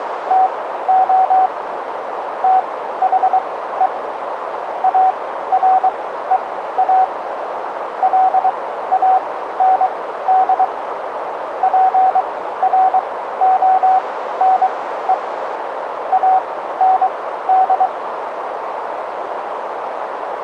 Morse code, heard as a keyed tone, machine-sent, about 23 wpm, spaced as for 14 wpm, 750 Hz, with radio static and a narrow filter. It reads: TO THE AREA LAND PRONE AND